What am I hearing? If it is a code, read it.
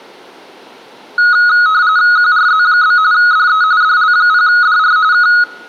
RTTY (45.45 baud, 170 Hz shift), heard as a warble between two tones, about 1360 Hz centre, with room echo. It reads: QRZ? DE DL0DR K